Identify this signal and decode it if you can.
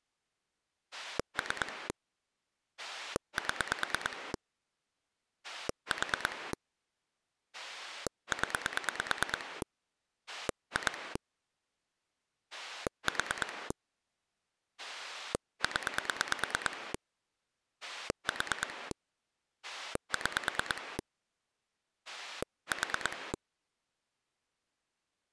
Pulse dialling, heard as a rotary dial, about 9 pulses a second. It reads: 3 7 4 0 2 4 0 4 6 4